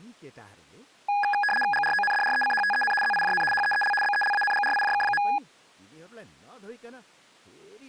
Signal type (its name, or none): RTTY